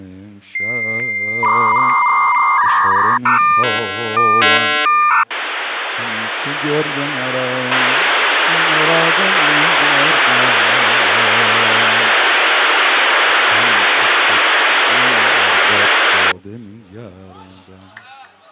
Dial-up modem handshake (V.34 or later), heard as a whistle, warbles, then hiss.